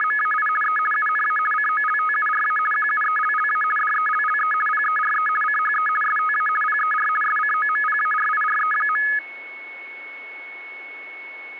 RTTY (50 baud, 450 Hz shift), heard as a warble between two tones, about 1480 Hz centre, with a steady whistle near 2200 Hz. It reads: … E UNA COLTURA QUELLA DELLE PERE CHE STA PER SCOMPARIRE.